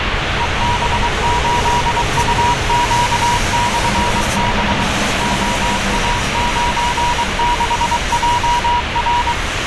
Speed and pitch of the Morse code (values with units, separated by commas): 23 wpm, 960 Hz